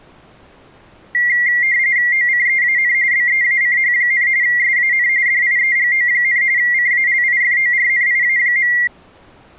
RTTY (45.45 baud, 170 Hz shift), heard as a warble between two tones, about 2000 Hz centre. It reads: OCEAN BEACH, SAN DIEGO, CALIFORNIA.